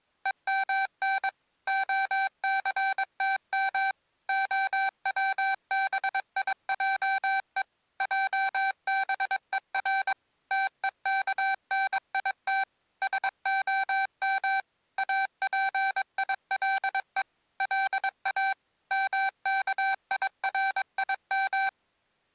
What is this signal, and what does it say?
Morse code (Hebrew alphabet), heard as electronic beeps, machine-sent, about 22 wpm, 780 Hz. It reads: ומן הסתם הצביעו עבור תוכנית שהם אפילו לא מכירים